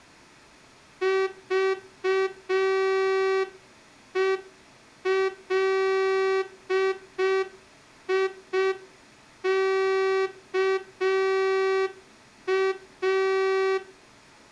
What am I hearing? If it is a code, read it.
Morse code, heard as a horn, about 5 wpm. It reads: VELIKA